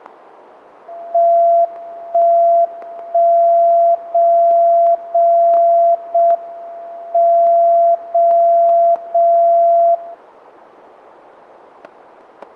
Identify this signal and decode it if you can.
Radio time signal (JJY), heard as a tone whose level steps once a second, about 680 Hz, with static crashes. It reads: 1 1 0 0 0 M 0 0 0